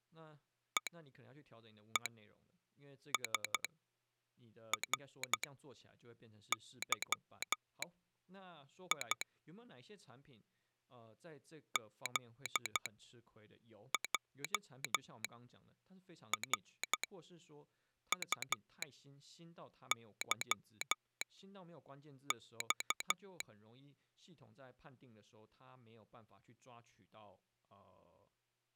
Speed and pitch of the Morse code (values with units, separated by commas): 12 wpm, spaced as for 6 wpm